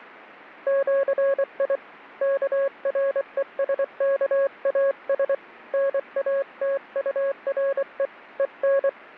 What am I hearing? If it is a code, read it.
Morse code (with Esperanto letters), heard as a keyed tone, hand-sent with a paddle, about 24 wpm, 550 Hz. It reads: ĜI KRESKAS NATURE EN